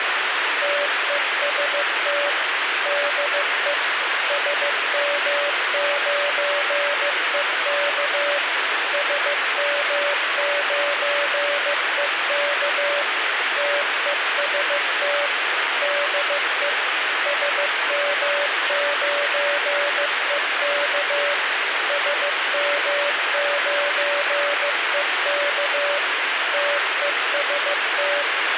Morse code, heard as a keyed tone, machine-sent, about 15 wpm, 580 Hz, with radio hiss and a squelch burst at the end. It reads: TEST DE SM9EK SM9EK TEST DE SM9EK SM9EK TEST